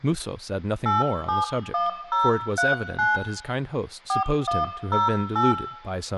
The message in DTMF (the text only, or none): 871039 4108